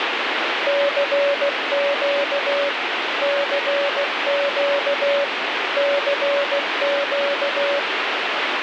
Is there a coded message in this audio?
Yes: Morse code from 0.6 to 7.9 s, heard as a keyed tone, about 16 wpm, 570 Hz, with heavy radio static. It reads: CQ CQ CQ